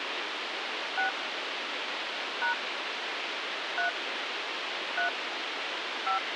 DTMF, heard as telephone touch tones, dialled by hand, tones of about 120 ms, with radio hiss. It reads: 6 # 3 3 5